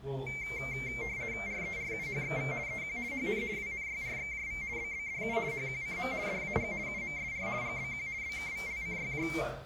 RTTY (50 baud, 170 Hz shift), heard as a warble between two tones, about 2200 Hz centre, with the noise of a restaurant. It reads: RERUHXV EQ HN WNYRXJV BBDU HQCM DAG UMSR GBQ BKVLCYJ